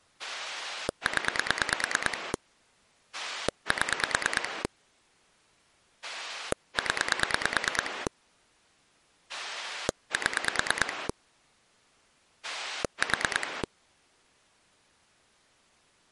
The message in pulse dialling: 0 7 0 7 4

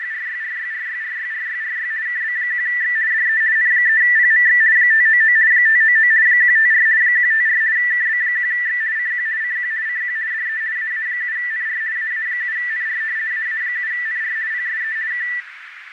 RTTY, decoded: … KB1X DE N3PMX 599 599 154 154 KB1X CQ CQ CQ DE AA7NR AA7NR AA7NR PSE K

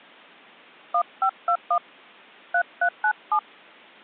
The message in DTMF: 1521 3397

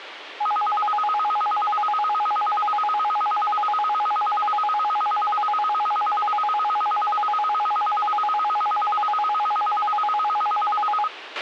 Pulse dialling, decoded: none

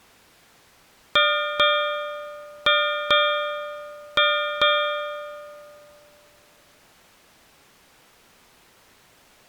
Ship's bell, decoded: 6

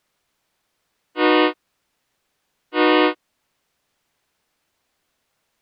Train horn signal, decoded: 2 short

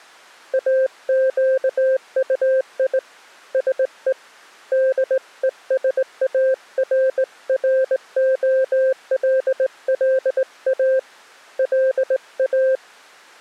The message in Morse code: AQUI SE DESARROLLA LA

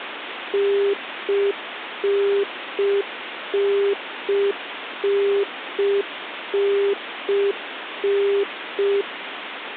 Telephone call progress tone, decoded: congestion tone

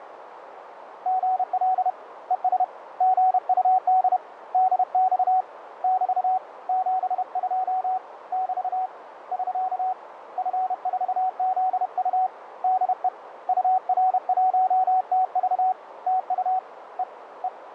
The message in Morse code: GL ES GUD DX <BT> 72 <BT> <SK> F4ZU DE UR1TV TU E E

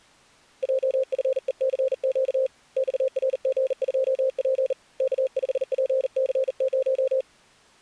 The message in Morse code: JFECQ XRG2P K5PC0

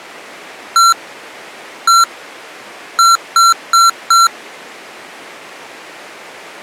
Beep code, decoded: 1-1-4

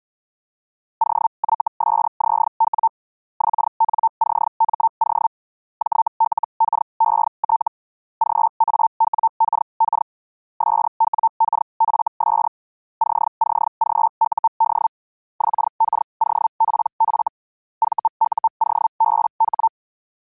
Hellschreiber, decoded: OYSZW XNCMO JLKET GAWKK SWKFS CCGUD XKOPF VUOBH

